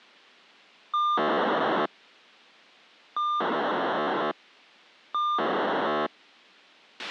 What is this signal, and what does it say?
POCSAG pager data (2400 baud), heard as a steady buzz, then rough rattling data, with a squelch burst at the end.